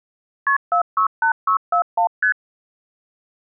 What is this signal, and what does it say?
Multi-frequency trunk signalling (R1, as on North American trunks), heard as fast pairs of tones, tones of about 100 ms. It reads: KP 468641 ST